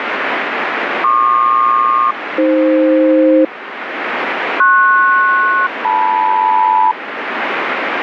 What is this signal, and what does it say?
Aircraft SELCAL, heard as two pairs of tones, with radio static. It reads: PQ-AF PS-LM